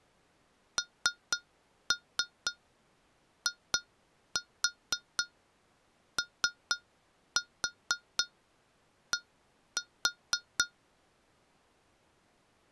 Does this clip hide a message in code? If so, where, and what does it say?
Yes: tap code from 0.8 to 10.7 s, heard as taps on glass, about 4 knocks a second. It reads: NIOD